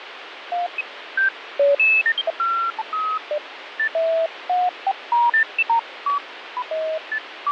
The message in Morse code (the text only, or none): none